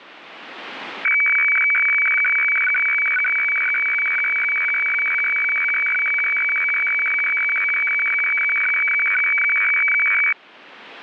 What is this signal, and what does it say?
Weather fax (radiofax), 120 lines a minute, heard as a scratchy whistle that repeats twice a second, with radio static.